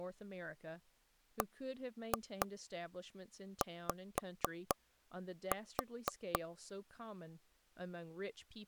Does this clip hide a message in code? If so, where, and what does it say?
Yes: tap code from 1.4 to 6.4 s, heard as taps on a table, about 4 knocks a second, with speech in English. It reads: BY